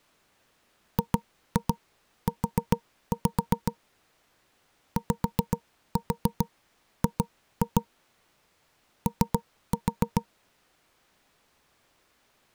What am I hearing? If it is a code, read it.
Tap code, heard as knocks on wood, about 7 knocks a second. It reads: GU YG O